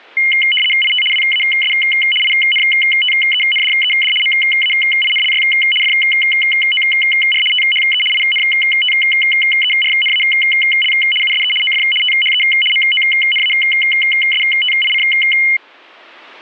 RTTY (75 baud, 850 Hz shift), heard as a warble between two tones, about 2550 Hz centre. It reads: IT WAS INTENDED MAINLY FOR THE INTERNAL USE OF THE MONASTIC